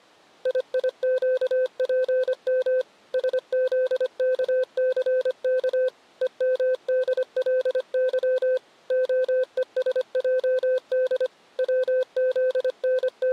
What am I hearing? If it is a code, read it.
Morse code, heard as a keyed tone, machine-sent, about 25 wpm, 510 Hz. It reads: IIQPM SZKCK EMDLY OESJD …